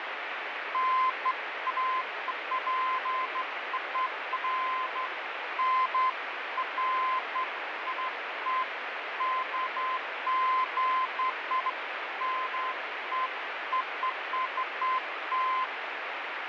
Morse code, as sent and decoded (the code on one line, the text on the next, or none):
none